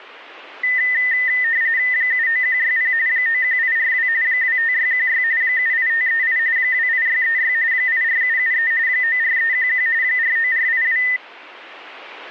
RTTY (45.45 baud, 170 Hz shift), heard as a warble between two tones, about 1900 Hz centre. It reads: 79160 91842 25616 78538 28636 84773 94311 49482